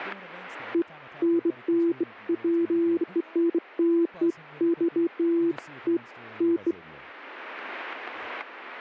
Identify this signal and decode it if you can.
Beeps of irregular length, with static crashes and speech in English. There is no code.